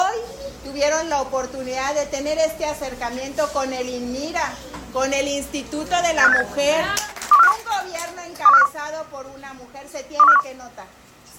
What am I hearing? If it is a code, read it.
Five-tone selective call (EEA), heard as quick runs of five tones, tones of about 40 ms. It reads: 85687 21451 21451 21451